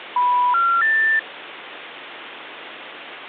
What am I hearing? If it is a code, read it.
Telephone call progress tone (North American plan), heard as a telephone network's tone, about 980, 1370, 1800 Hz, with phone line noise and hum. Special information tone.